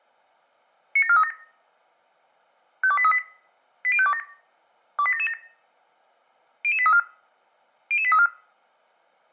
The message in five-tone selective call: 97437 52838 80527 28777 00834 00834

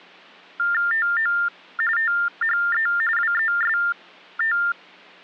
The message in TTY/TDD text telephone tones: TO THE WEST

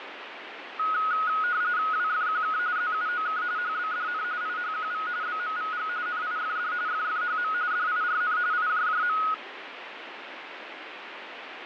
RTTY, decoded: WFQK ZUOK HBDN IHQV BMVG NIFD FFHM DIRN IJJM

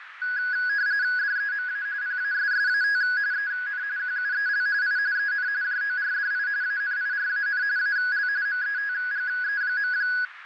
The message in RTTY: DEMA PASSAT EN QUEL I EN JORDI ANIRAN AL METGE.

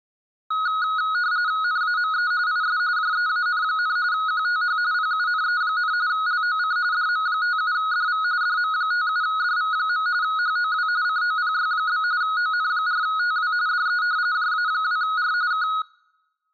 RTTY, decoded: NAME IS JEAN, QTH PUNE, LOC DM57DV DM57DV. HOW COPY? ON4TW DE JA2R K

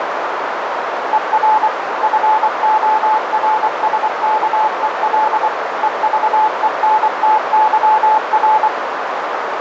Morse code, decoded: ER FORSKEL EVENTYR

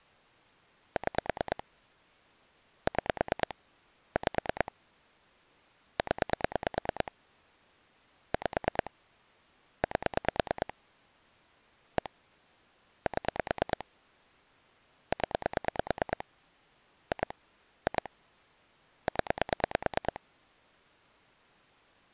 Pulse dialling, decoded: 6 6 5 0 5 8 1 7 0 2 2 0

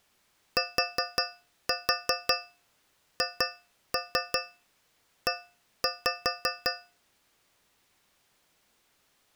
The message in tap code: THE

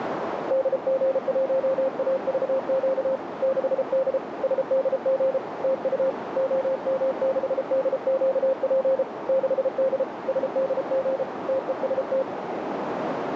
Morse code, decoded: DG1AVQ 6D SDG TU OM6DQP 6D SDG TEST

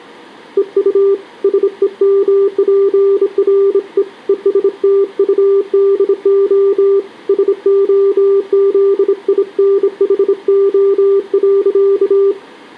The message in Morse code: EU SEMPRE ESTUDO SOZINHO.

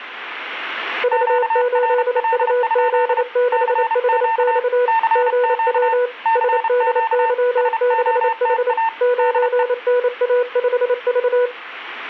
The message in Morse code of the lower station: V8UZ6HX GW SDY6H 9NA5V

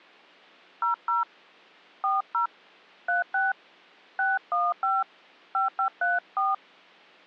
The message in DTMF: 00 40 36 615 5534

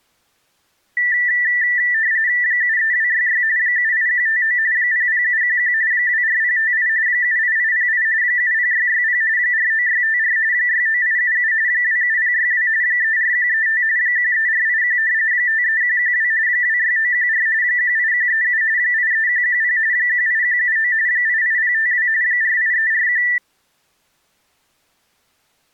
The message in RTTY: 73266 78159 00711 24058 78808 70660 49654 69877 27062 34135 13481 53112 26914 18137 83110 18179 88052 48341

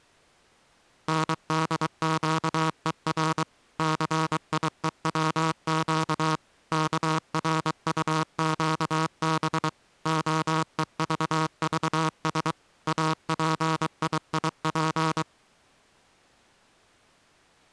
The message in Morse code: NDQER CIEWQ KRUQB OEVVS APIIP

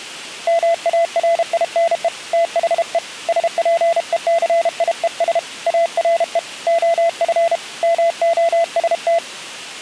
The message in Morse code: MARINE THE SPECIES ARE OF MOST

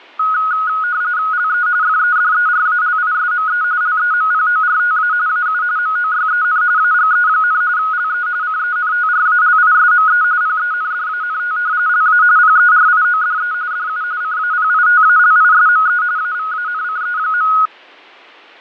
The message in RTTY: LE FEDERALISME LEMPORTA AU MOYEN AGE, LE CENTRALISME PENDANT LA PERIODE DU CAPITALISME AVANCE.

